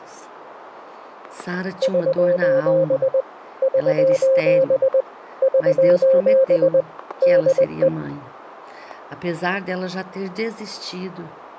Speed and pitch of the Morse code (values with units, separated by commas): 20 wpm, 530 Hz